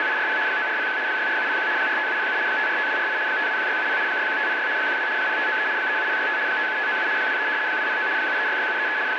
RTTY (75 baud, 170 Hz shift), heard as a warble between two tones, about 1600 Hz centre, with radio static and a steady whistle near 870 Hz. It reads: … 9401 64701 45707 545248 521670 61506 12 0593 37065 57597 23 209 7366733 …